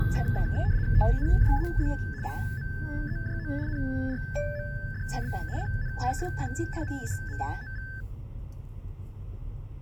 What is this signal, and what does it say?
RTTY (75 baud, 170 Hz shift), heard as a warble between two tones, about 1650 Hz centre, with the noise inside a car. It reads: TNJAB OMEJO NRMDB CNJFF MHMOV